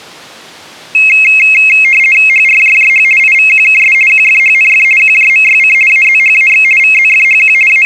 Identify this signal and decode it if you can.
RTTY (50 baud, 450 Hz shift), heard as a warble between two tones, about 2350 Hz centre. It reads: HRJJH IVQKS QFHNF QJMYC AZHAX VZFHQ …